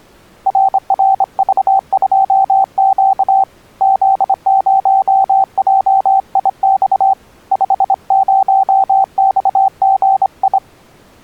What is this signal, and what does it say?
Morse code, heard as a keyed tone, hand-sent with a straight key, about 25 wpm, 780 Hz. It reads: RRV2Q Z0JIX 50XGI